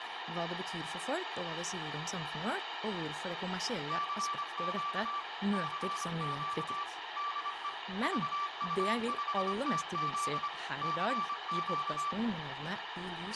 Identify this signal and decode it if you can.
Morse code, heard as a keyed tone, machine-sent, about 25 wpm, 1160 Hz, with radio static, room echo and speech in Norwegian. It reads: CQ CQ DE VU5TZ CQ